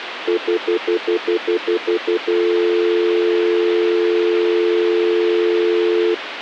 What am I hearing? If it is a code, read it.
Telephone call progress tone (North American plan), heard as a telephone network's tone, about 350, 440 Hz, 0.1 s on and 0.1 s off, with phone line noise. Stutter dial tone.